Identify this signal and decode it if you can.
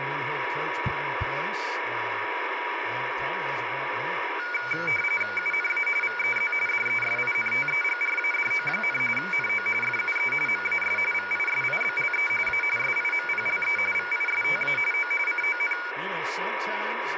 RTTY (45.45 baud, 850 Hz shift), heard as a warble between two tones, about 1850 Hz centre, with radio static and speech in English. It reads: UNA VEZ DESINTEGRADO, NO FUE MAS VISIBLE A SIMPLE VISTA O CON